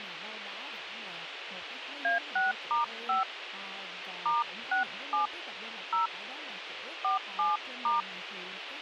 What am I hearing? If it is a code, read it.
DTMF, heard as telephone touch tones, dialled by hand, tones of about 130 ms, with radio hiss and speech in Vietnamese. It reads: A6*5 *67 0 47*